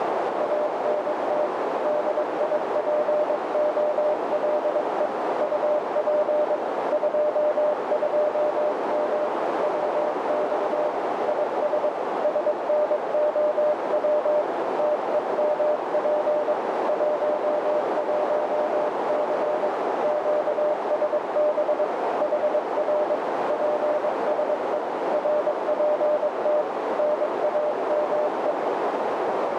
Morse code, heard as a keyed tone, hand-sent with a paddle, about 22 wpm, 600 Hz, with heavy radio static and a narrow filter. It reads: ANT DIPOLE UP 22M WX IS SNOW TEMP 11C QSB HR PSE RPT NAME